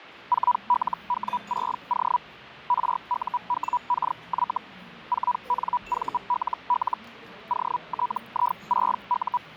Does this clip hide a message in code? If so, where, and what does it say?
Yes: Hellschreiber (Feld-Hell, 122.5 baud) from 0.3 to 9.4 s, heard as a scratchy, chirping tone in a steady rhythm, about 980 Hz, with the noise of a restaurant. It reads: 4LW6O RUWKY 4NVLL OTI6U